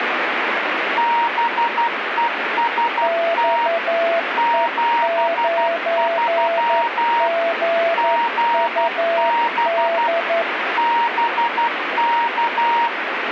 Morse code, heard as two keyed tones, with radio static. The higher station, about 12 wpm, 940 Hz: BEST 73 GB BK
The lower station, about 11 wpm, 670 Hz: XE9GUD